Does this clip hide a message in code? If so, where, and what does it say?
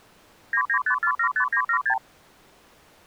Yes: multi-frequency trunk signalling (R2, with the far end's replies) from 0.5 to 2.0 s, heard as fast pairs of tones, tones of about 80 ms. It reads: 995475976